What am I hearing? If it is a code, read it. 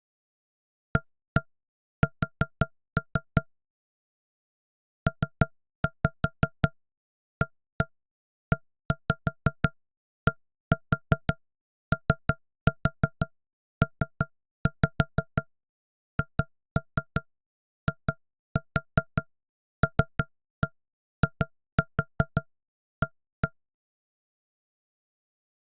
Tap code, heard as knocks on wood, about 5 knocks a second. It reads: AS PAEDOPHILIA